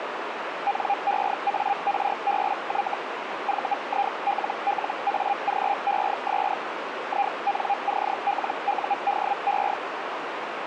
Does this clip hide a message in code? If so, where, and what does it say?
Yes: Hellschreiber (Feld-Hell, 122.5 baud) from 0.7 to 9.7 s, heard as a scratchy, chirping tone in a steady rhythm, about 800 Hz, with radio static and a narrow filter. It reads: NEARBY VILLAGES INCLUDE